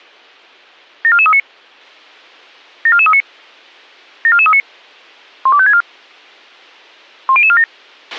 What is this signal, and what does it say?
Five-tone selective call (ZVEI), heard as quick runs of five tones, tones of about 70 ms, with a squelch burst at the end. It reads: 74439 74439 74439 12564 10047